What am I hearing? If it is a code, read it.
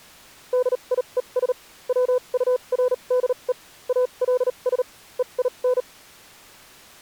Morse code, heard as a keyed tone, machine-sent, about 38 wpm, spaced as for 30 wpm, 500 Hz. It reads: DIES WURDE ALS EIN